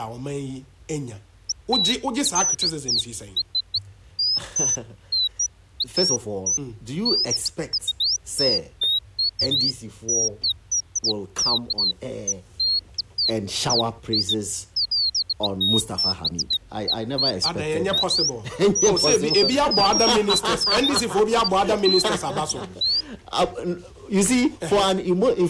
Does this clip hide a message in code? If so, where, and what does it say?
No, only bird-like chirps.